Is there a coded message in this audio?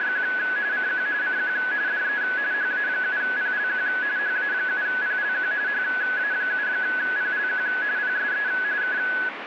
Yes: RTTY (45.45 baud, 170 Hz shift) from 0.0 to 9.3 s, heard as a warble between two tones, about 1600 Hz centre, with radio static. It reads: … CQ CQ DE HA7PLQ HA7PLQ HA7PLQ PSE K